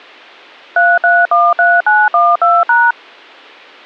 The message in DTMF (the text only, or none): 3313912#